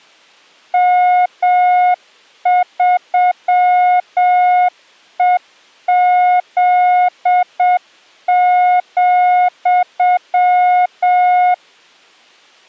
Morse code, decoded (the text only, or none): M3EZ,